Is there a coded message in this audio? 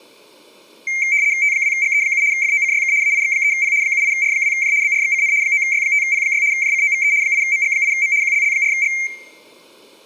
Yes: RTTY (75 baud, 170 Hz shift) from 0.9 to 9.1 s, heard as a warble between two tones, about 2200 Hz centre. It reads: T2GE7 FOCYK AIX3P 78R2J BRXCN 9Y5P6 JCOVE 8MG8M QLL4G